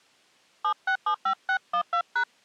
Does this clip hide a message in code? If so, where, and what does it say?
Yes: DTMF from 0.6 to 2.2 s, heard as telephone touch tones, dialled by hand, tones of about 80 ms. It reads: 7675612#